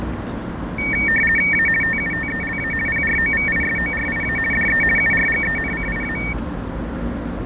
RTTY (50 baud, 450 Hz shift), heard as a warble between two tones, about 2050 Hz centre, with fading, static crashes and the noise of a residential street. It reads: A TUTELA PROVISORIA DE URGENCIA